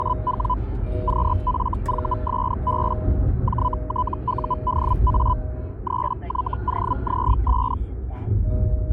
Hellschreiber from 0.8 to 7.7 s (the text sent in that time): QFVSB JTUDA 3YOZS